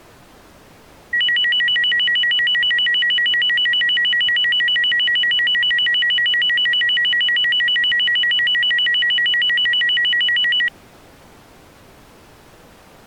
A tone that alternates evenly between two pitches. There is no code.